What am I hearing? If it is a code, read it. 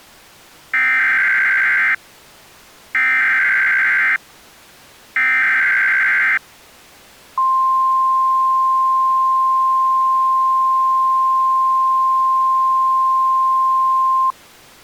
Emergency Alert System (SAME) tones (header bursts, then the 1050 Hz attention tone), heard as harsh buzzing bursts, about 520.83 baud.